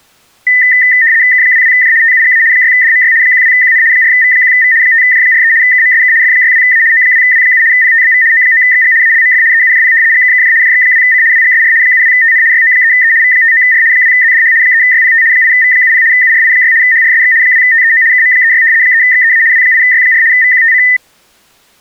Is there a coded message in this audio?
Yes: RTTY (75 baud, 170 Hz shift) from 0.5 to 21.0 s, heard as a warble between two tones, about 1900 Hz centre. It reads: K22J TUGA 6DMY 12QN 4V1V 5J43 KMSK F62A O2W7 PTBV O9XG ALMF EUJP GKKJ JX2C WGSR 72TN YO3E V59R 2ZDH 3YPT 8V70 URI6 HRSX 2TEO KM36 3XEA W8Y4 VQTC